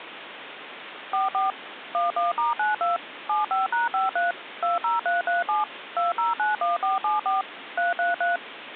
DTMF, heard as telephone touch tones, dialled by machine, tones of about 150 ms, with phone line noise. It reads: 44 11*92 75#53 20337 2091474 333